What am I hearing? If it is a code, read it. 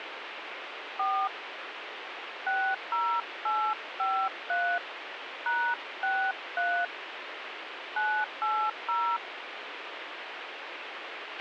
DTMF, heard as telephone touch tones, dialled by hand, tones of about 280 ms, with radio hiss and a squelch burst at the end. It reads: 4 60853 #63 980